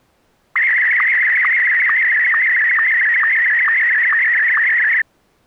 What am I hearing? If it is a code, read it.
SSTV (slow-scan television), Martin M1, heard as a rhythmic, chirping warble.